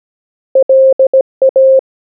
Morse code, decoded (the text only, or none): LA